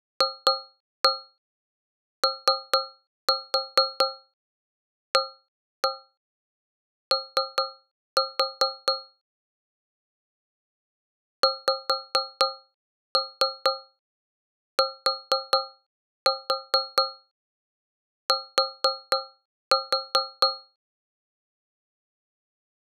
Tap code, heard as taps on a metal pipe, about 4 knocks a second. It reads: FOAO XTT